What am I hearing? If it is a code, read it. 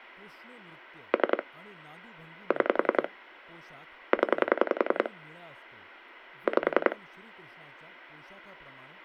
Pulse dialling, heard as clicks on a phone line, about 10 pulses a second, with speech in Marathi. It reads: 3 6 0 5